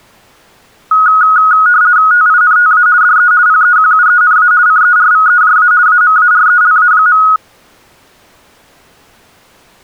RTTY (50 baud, 170 Hz shift), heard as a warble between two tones, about 1360 Hz centre. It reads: TINTA DE PEQUENA CERVEJA AMARELA.